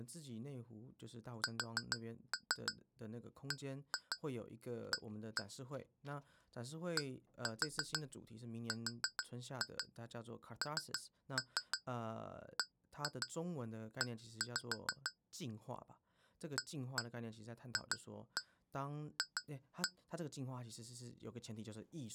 Tap code, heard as taps on glass, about 6 knocks a second, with speech in Chinese. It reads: SBA DRNBE AFF